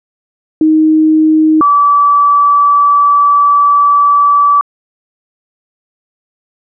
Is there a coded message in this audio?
Yes: two-tone page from 0.6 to 4.6 s, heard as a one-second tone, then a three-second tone, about 310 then 1150 Hz.